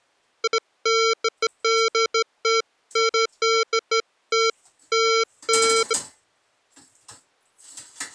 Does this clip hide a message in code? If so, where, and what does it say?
No, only beeps of irregular length.